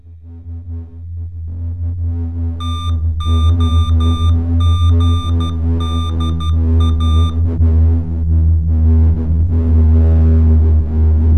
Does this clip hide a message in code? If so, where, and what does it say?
Yes: Morse code (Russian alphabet) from 2.5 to 7.4 s, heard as electronic beeps, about 12 wpm, 1200 Hz, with room echo. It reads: ТОГДА